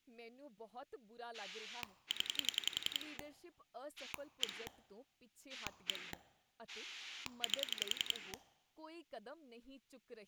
Pulse dialling, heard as a rotary dial, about 11 pulses a second, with speech in Punjabi. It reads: 0 1 1 8